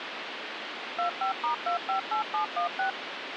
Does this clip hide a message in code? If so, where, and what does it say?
Yes: DTMF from 1.0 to 2.9 s, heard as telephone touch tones, dialled by machine, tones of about 110 ms, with phone line noise. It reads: 25*258716